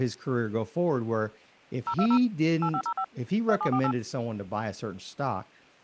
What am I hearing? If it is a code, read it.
DTMF, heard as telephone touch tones, dialled by machine, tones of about 70 ms, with speech in English. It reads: 020 8505 2748